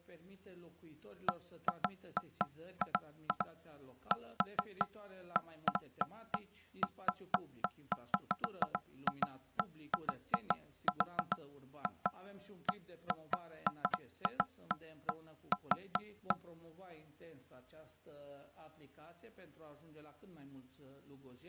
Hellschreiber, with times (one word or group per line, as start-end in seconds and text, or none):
none